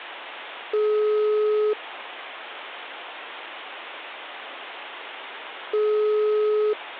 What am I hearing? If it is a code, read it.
Telephone call progress tone (single-tone plan, as in most of Europe), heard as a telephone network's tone, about 420 Hz, 1 s on and 4 s off. Ringback tone.